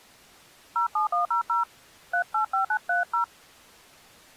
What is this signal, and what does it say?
DTMF, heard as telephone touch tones, dialled by hand, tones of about 100 ms. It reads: 07100 385930